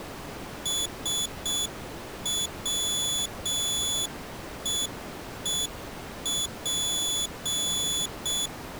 Morse code, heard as a high beeper, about 6 wpm, 3450 Hz. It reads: SWEEP